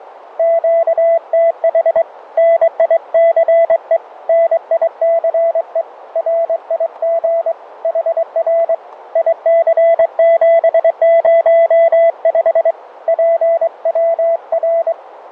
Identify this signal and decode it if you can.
Morse code, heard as a keyed tone, hand-sent with a straight key, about 23 wpm, 670 Hz, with radio static. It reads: QTH NICE NICE RIG HR IC705 PWR